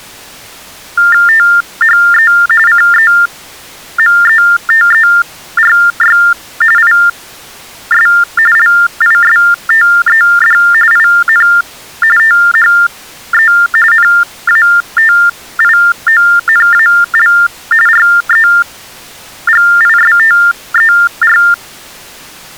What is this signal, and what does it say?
TTY/TDD text telephone tones (45.45 baud Baudot), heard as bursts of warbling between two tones, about 400 Hz shift, 1600 Hz centre. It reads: THE CEMETERY IS LISTED IN THE NATIONAL REGISTER